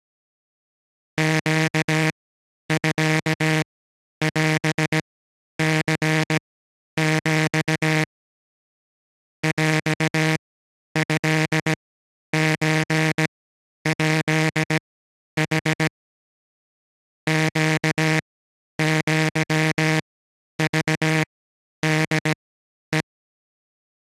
Morse code (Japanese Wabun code), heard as a buzzer, machine-sent, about 17 wpm, spaced as for 10 wpm. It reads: ネミオニヒ ヰトソヱヌ ネアクホヘ